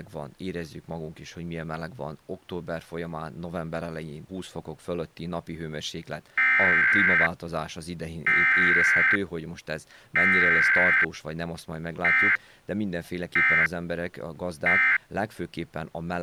Emergency Alert System (SAME) tones (header bursts, then end-of-message bursts), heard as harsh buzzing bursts, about 520.83 baud, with speech in Hungarian.